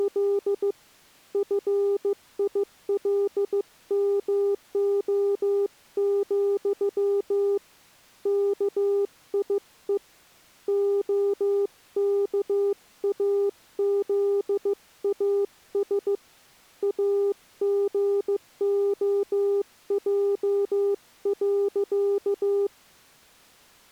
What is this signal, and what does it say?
Morse code, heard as a keyed tone, hand-sent with a bug key, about 15 wpm, 400 Hz. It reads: … FILMO, KIE OKAZAS AGOJ.